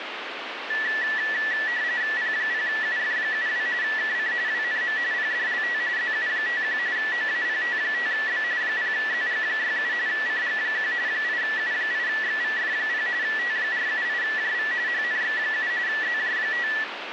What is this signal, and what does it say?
RTTY (45.45 baud, 170 Hz shift), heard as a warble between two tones, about 1850 Hz centre, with radio static. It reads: P0UF72 KC WNM PDLT ZU51 OAPT5B 0ZG67 CG1 8U8XVF0 T478JV HNX7 ZJ5